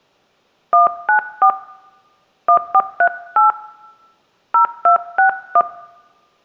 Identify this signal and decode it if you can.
DTMF, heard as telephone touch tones, dialled by hand, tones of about 100 ms, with room echo. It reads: 194 1438 0261